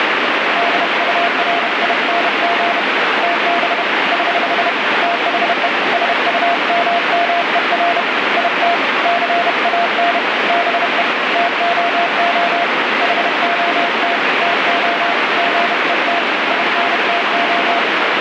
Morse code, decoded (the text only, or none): DURING TB <HH> THE SUMMER IT CAN BE TOO HOT TO GET INTO